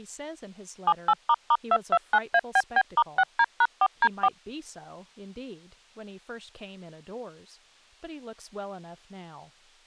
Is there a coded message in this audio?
Yes: DTMF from 0.9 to 4.3 s, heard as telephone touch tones, dialled by machine, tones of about 50 ms, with speech in English. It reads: 78**229ABB*6D#4D4